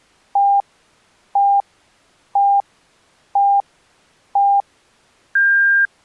Radio time signal (five pips and a higher one, as on Chinese radio), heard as pips.